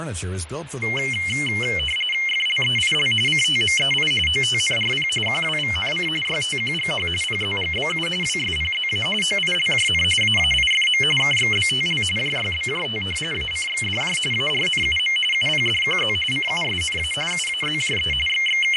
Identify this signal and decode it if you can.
RTTY (45.45 baud, 850 Hz shift), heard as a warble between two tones, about 2550 Hz centre, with radio static, fading and speech in English. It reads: FLEIL CTMEI OTNRP QWVNC YTQGH PZGBU WSPZA OILJN AAIFM KXBTL JYBJT ACXDJ ARNUM UPDQZ CUSNA UAZJE …